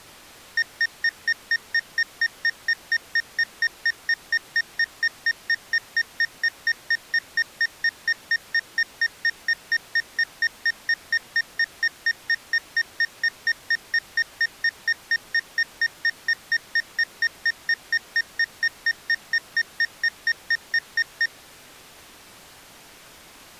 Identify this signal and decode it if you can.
Evenly repeated beeps. There is no code.